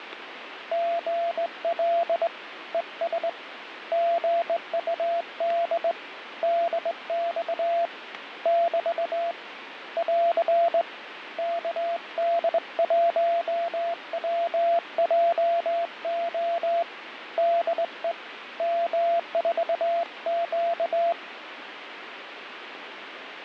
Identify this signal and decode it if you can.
Morse code, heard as a keyed tone, hand-sent with a straight key, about 20 wpm, 680 Hz, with radio static. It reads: GL ES GUD DX <BT> <AR> KD1WJO DE M4Q